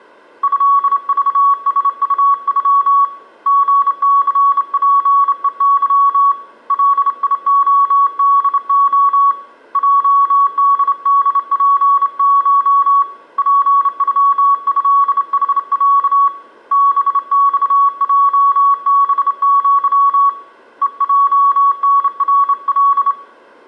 Morse code (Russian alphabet), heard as a keyed tone, hand-sent with a straight key, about 28 wpm, 1120 Hz, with room echo. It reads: ЭЖСУЮ ГЦПЕЫ ЛИОДО ЙДДПШ ПЮЭХЯ БЬЙБЪ ЕЙНРЛ